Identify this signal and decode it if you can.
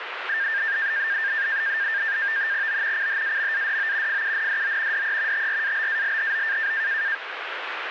NAVTEX (SITOR-B), 100 baud, 170 Hz shift, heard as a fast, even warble, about 1700 Hz centre, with radio static. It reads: O CHAMADO FUNDO DE TRABALHO